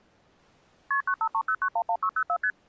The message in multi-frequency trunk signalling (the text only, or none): KP 9530911604 ST